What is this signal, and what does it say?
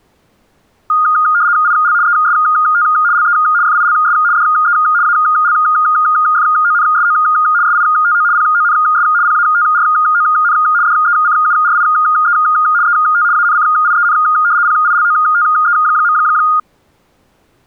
RTTY (75 baud, 170 Hz shift), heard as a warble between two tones, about 1330 Hz centre. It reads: IL EST LE FILS DE ALFONSO SITO PONS PATRON DECURIE ET ANCIEN PILOTE.